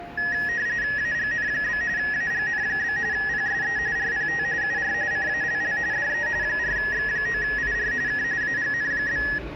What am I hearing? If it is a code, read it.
RTTY (45.45 baud, 170 Hz shift), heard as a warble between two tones, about 1800 Hz centre, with the noise of a subway station. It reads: AGN? AGN? PSE RPT UR CALL DE 4X9IR K AGN?